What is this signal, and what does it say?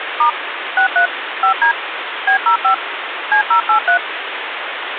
DTMF, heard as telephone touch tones, dialled by machine, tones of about 100 ms, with phone line noise. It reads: * 63 5D B05 C083